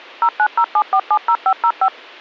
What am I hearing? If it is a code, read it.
DTMF, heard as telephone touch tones, dialled by machine, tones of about 70 ms. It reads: 0907470505